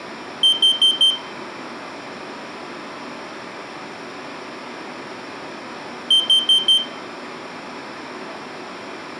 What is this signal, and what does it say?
Alarm pattern, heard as an alarm's beeps, played twice, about 3150 Hz, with room echo. Temporal four. Carbon monoxide.